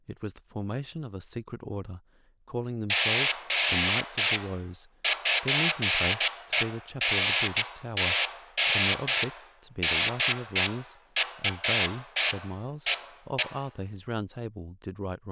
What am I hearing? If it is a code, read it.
Bursts of noise, with room echo and speech in English. There is no code.